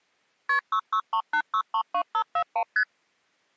Multi-frequency trunk signalling (R1, as on North American trunks), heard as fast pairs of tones, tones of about 80 ms. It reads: KP 6638632541 ST